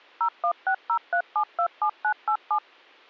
DTMF, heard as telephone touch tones, dialled by machine, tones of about 80 ms. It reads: 01603727987